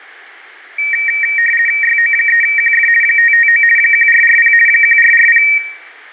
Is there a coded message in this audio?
Yes: RTTY (50 baud, 450 Hz shift) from 0.8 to 5.6 s, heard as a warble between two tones, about 2100 Hz centre, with radio static. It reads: YO3QF 559 1440 1440